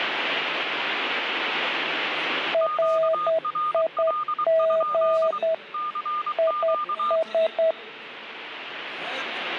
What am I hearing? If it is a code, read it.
Morse code, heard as two keyed tones. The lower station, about 10 wpm, 650 Hz: RIG IS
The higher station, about 23 wpm, 1220 Hz: QRL? CQ